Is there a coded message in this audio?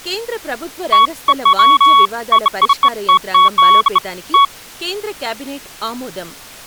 No, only beeps of irregular length, with speech in Telugu.